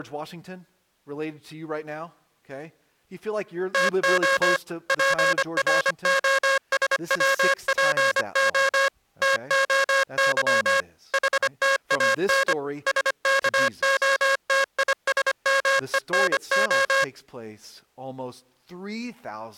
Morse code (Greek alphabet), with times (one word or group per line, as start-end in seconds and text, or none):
3.7-4.6 ΤΟ
4.9-8.9 ΠΡΟΣΩΠΟ
9.2-10.8 ΤΟΥ
11.1-12.5 ΗΤΑΝ
12.9-17.0 ΣΚΟΤΙΣΜΕΝΟ